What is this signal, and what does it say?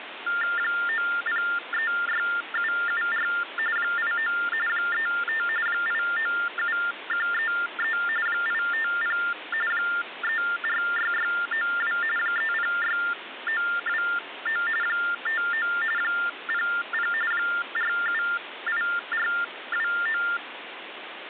TTY/TDD text telephone tones (45.45 baud Baudot), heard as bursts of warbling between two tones, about 400 Hz shift, 1600 Hz centre, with phone line noise. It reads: 9036774 89 35 897133 850 346692 306929 59 00 478429